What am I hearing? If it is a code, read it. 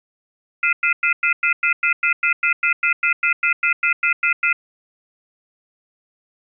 Telephone call progress tone (North American plan), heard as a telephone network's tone, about 1400, 2050, 2450, 2600 Hz, 0.1 s on and 0.1 s off. Off-hook warning tone.